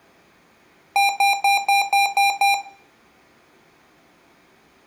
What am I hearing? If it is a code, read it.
Beep code, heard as beeps from a small speaker, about 800 Hz, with room echo. 7 short. In AMI BIOS tables: virtual mode exception error; in Dell tables: processor failure.